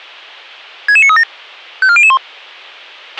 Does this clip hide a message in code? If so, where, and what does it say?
Yes: five-tone selective call (ZVEI) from 0.9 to 2.2 s, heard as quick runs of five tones, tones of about 70 ms, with a squelch burst at the end. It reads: 66937 54001